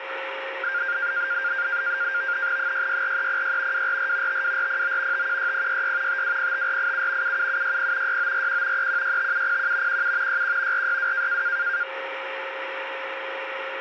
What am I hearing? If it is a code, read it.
NAVTEX (SITOR-B), 100 baud, 170 Hz shift, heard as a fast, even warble, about 1500 Hz centre, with radio static and a steady whistle near 540 Hz. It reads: 664306 244 52409 516066 5205487 77760 6941 3165701 17 61 462